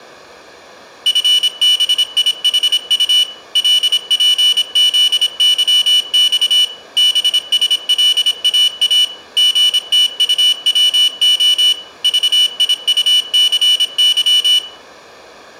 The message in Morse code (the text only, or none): FBIHU LPZYX BSLAA GTUWO VIUCY